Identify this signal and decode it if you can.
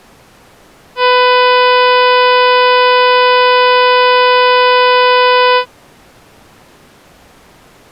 Ship horn signal, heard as a ship's horn, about 500 Hz. 1 long. At sea: a vessel nearing a blind bend, or under power and making way in fog.